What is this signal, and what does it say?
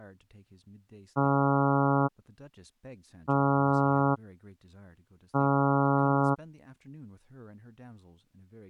Ship horn signal, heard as a ship's horn, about 140 Hz, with speech in English. 3 short. At sea: I am operating astern propulsion.